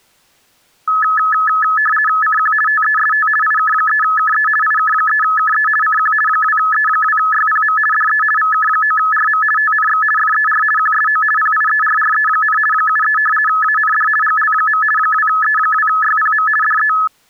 RTTY (50 baud, 450 Hz shift), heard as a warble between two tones, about 1500 Hz centre. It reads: CQ TEST IK3KE IK3KE CQ 2E2YPM DE VK9RM TNX FER QSO PIERRE, 73 AND GL. 2E2YPM DE